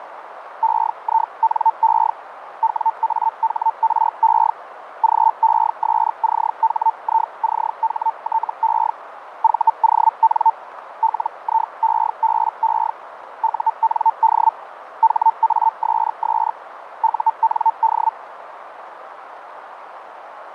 Hellschreiber (Feld-Hell, 122.5 baud), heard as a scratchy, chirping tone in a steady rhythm, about 900 Hz, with radio static and a narrow filter. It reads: EINE WAHRE GESCHICHTE VON LIEBE UND HASS UND